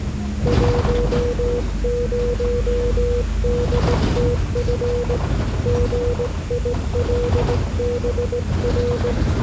Morse code, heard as a keyed tone, hand-sent with a straight key, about 18 wpm, 480 Hz, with the noise inside a bus. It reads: 10DTF GILBR